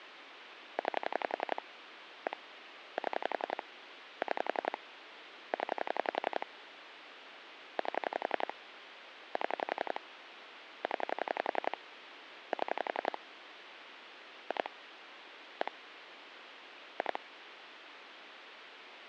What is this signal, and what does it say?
Pulse dialling, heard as clicks on a phone line, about 11 pulses a second, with phone line noise. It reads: 9 1 7 6 0 8 7 0 7 2 1 2